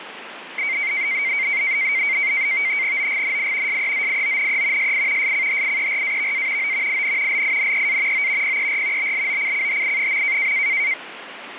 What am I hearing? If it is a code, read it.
NAVTEX (SITOR-B), 100 baud, 170 Hz shift, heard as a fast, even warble, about 2200 Hz centre, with radio static. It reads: OGNI SEZIONE SI SCHIERAVA O IN LINEA O PER BLOCCHI.